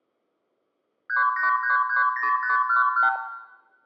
Multi-frequency trunk signalling (R2, with the far end's replies), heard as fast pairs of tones, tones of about 130 ms, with room echo. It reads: 38330511